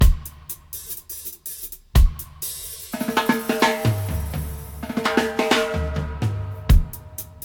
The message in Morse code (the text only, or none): none